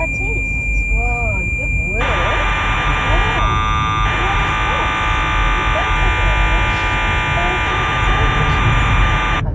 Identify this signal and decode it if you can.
Cassette data (Kansas City type), 1200 baud, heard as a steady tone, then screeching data, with the noise inside a car.